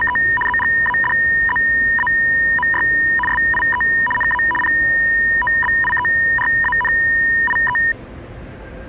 RTTY (75 baud, 850 Hz shift), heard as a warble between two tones, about 1410 Hz centre, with the noise of a subway station. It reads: … ZGADZAMY SIE NA POBIERANIE